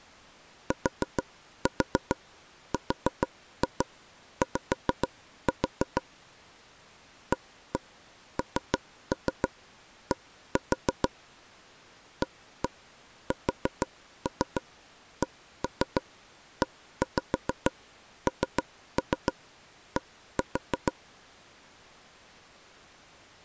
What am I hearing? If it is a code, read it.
Tap code, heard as taps on a table, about 6 knocks a second. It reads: TRY AND ASCEND